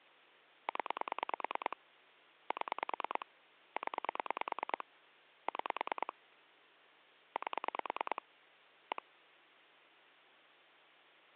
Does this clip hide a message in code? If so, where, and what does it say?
Yes: pulse dialling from 0.7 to 9.0 s, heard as clicks on a phone line, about 9 pulses a second, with hum. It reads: 0 7 0 6 8 1